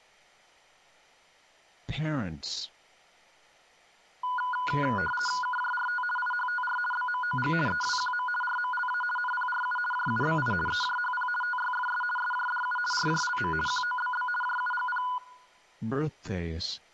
RTTY (50 baud, 450 Hz shift), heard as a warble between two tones, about 1220 Hz centre. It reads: KJRT IHTR BMOG EWQM RMLA NPRU JUBI EJHP TYFS SJDU RJLM QOBB JUGP